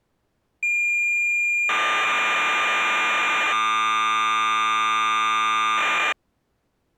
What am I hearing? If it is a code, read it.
Cassette data (Kansas City type), 1200 baud, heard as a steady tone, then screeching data.